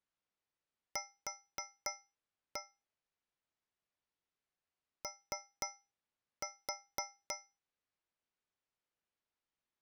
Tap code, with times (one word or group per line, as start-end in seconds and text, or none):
1.0-2.6 Q
5.0-7.4 O